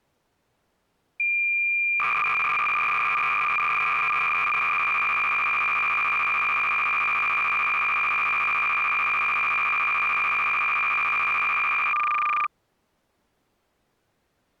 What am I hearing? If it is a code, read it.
Cassette data (Kansas City type), 300 baud, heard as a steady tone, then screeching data.